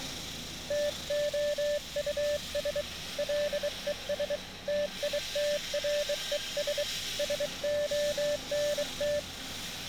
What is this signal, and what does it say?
Morse code, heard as a keyed tone, hand-sent with a bug key, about 23 wpm, 590 Hz, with street noise. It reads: TOUS LES TITRES SONT